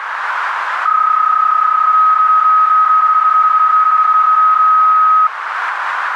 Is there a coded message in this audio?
Yes: PSK31 (31.25 baud) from 0.9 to 5.3 s, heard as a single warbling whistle, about 1270 Hz, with radio static and a narrow filter.